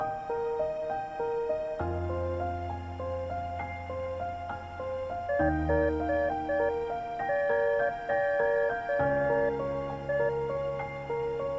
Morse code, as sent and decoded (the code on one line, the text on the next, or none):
.... --- .
HOE